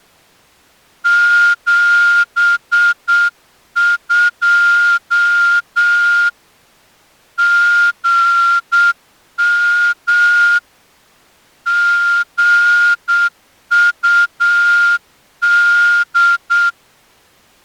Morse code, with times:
1.1-6.3 72
7.4-10.6 GM
11.7-16.7 GUD

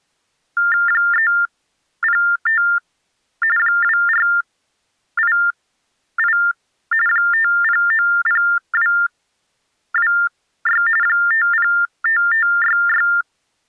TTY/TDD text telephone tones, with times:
0.9-2.6 305
3.6-6.4 2488
7.1-10.8 5090226
11.0-13.1 505566

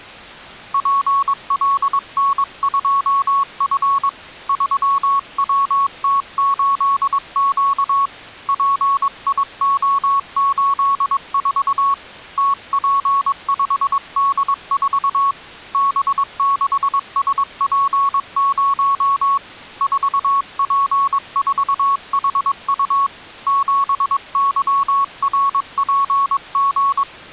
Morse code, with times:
0.7-4.1 PLN2F
4.5-8.1 3WT8Q
8.5-11.9 PIO84
12.4-15.3 TP5D4
15.7-19.4 B6SP0
19.8-23.1 4P4HU
23.5-27.0 7YRPG

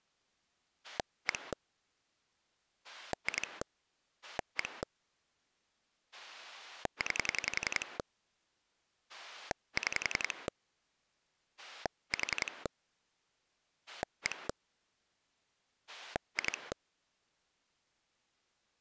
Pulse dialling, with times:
0.8-1.5 1
2.8-3.6 2
4.2-4.8 1
6.1-8.0 9
9.1-10.5 6
11.6-12.7 4
13.9-14.5 1
15.9-16.7 2

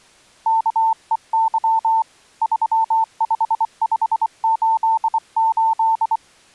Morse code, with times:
0.5-2.0 KEY
2.4-6.2 35588

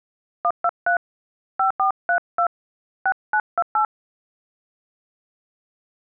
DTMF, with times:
0.4-1.0 123
1.6-2.5 5432
3.1-3.8 6928

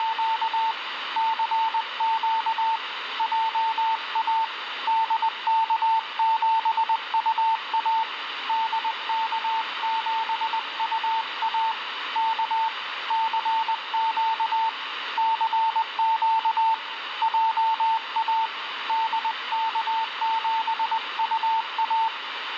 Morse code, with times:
0.0-0.7 …
1.2-2.8 CQ
3.2-4.4 JA
4.9-8.0 DK7UA
8.5-11.7 DK7UA
12.2-12.7 K
13.1-14.7 CQ
15.2-16.7 CQ
17.2-18.5 JA
18.9-22.1 DK7UA

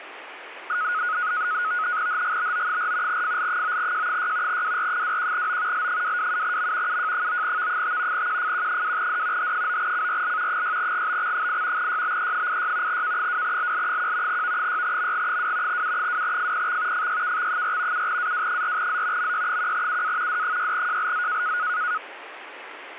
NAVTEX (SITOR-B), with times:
2.1-3.2 HGBO4
3.1-4.6 FL9J6
4.5-5.9 WR21O
5.7-7.0 L227M
6.9-8.3 UJ9V5
8.1-9.5 QFQ2D
9.4-10.6 H9CRL
10.5-11.9 6GBX8
11.8-13.0 YBE86
12.9-14.4 K2LL1
14.3-15.8 V6MG2
15.7-17.1 U2FPX
16.9-18.1 FYKX4
17.9-19.3 7AW4Z
19.2-20.4 MY1UA
20.3-21.6 D6JLZ

